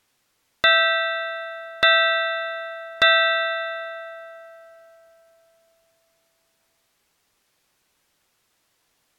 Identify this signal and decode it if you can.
Clock strike, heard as a bell. 3. Three o'clock.